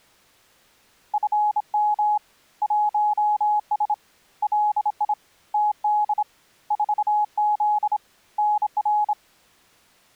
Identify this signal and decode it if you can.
Morse code, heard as a keyed tone, hand-sent with a straight key, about 26 wpm, 840 Hz. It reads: FM 1S LI TD 4Z NR